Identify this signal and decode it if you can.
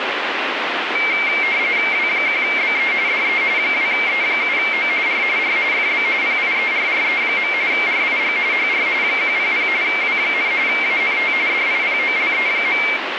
RTTY (45.45 baud, 170 Hz shift), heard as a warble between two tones, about 2200 Hz centre, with radio static. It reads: W1BE DE 2E7O R R FB PIERRE. RIG HR 100 W, ANT DIPOLE.